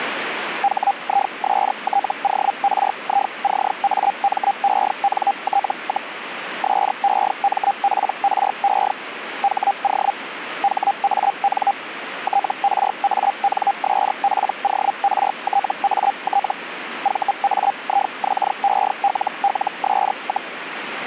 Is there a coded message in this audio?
Yes: Hellschreiber (Feld-Hell, 122.5 baud) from 0.6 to 20.5 s, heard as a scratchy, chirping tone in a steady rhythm, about 800 Hz, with radio static. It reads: HISTORICAMENT, SEMPRE HO HAN TRANSPORTAT VAIXELLS,